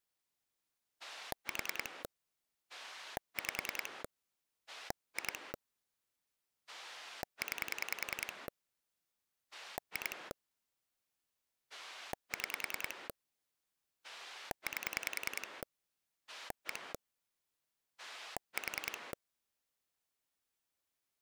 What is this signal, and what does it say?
Pulse dialling, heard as a rotary dial, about 10 pulses a second. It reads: 4 5 2 9 2 6 8 1 4